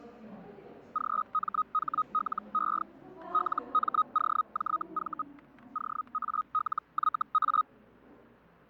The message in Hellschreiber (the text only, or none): GMHLE LMOJV OALYA